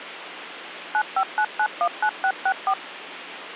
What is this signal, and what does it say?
DTMF, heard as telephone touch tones, dialled by machine, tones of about 70 ms, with phone line noise. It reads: 959919664